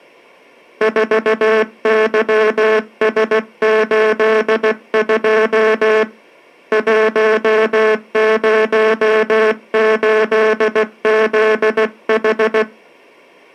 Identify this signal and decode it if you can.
Morse code, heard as a buzzer, hand-sent with a paddle, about 16 wpm. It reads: 4YS82 108ZH